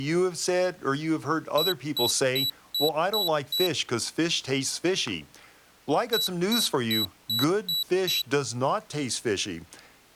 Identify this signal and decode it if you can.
Beep code, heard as a piezo beeper, played twice, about 3950 Hz, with speech in English. 6 short. In AMI BIOS tables: keyboard controller gate A20 failure; in Dell tables: video card failure.